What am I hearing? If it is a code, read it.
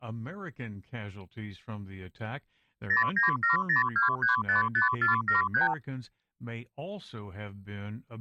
Multi-frequency trunk signalling (R2, with the far end's replies), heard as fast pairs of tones, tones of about 130 ms. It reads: 09702355473